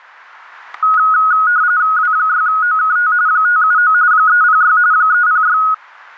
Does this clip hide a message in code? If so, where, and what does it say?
Yes: RTTY (45.45 baud, 170 Hz shift) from 0.8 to 5.7 s, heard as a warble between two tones, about 1360 Hz centre, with static crashes. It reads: W6OKT 579 306 306